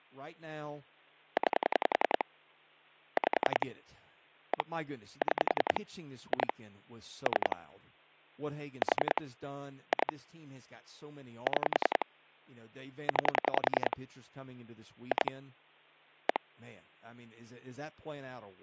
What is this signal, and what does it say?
Pulse dialling, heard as clicks on a phone line, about 10 pulses a second, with hum and speech in English. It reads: 9 5 1 6 2 3 4 2 6 9 2 1